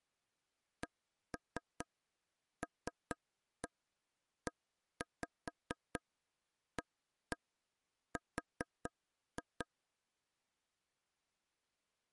Tap code, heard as taps on a table, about 4 knocks a second. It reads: CLEAR